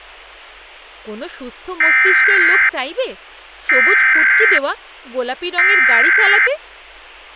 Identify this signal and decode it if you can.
Emergency Alert System (SAME) tones (header bursts), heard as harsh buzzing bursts, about 520.83 baud, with speech in Bangla.